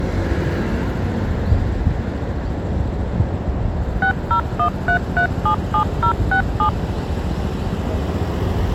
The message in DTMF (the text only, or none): 6013377067